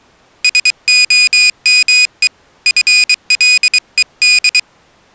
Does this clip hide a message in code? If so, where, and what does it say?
Yes: Morse code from 0.4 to 4.7 s, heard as a high beeper, hand-sent with a paddle, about 23 wpm, 2500 Hz. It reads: SOME FLED